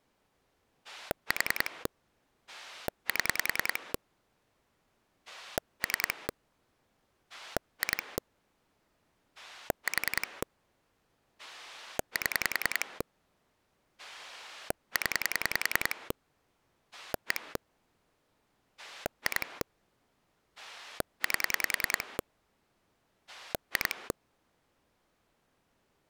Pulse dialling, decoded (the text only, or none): 4 7 3 2 4 7 0 1 2 8 2